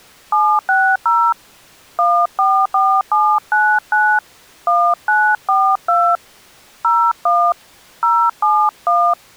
DTMF, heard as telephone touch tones, dialled by hand, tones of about 270 ms. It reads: 760 144799 1942 01 071